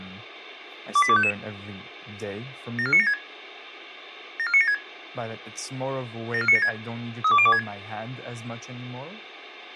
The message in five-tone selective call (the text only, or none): 28255 74976 74976 74976 32026